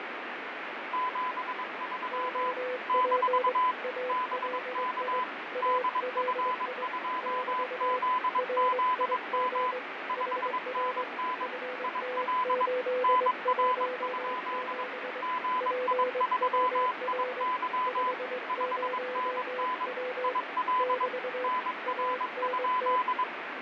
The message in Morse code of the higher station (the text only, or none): 73 - BK DF2ZZM 5NN IL NR? GI3IY 5NN IL NR?